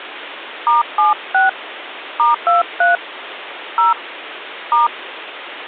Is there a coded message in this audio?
Yes: DTMF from 0.7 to 4.9 s, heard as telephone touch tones, dialled by hand, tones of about 150 ms, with phone line noise. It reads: *76 *23 0 *